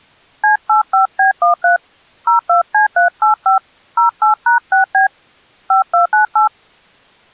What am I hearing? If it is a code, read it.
DTMF, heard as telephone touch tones, dialled by hand, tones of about 120 ms. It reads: C85B13 02C385 08#6B 5298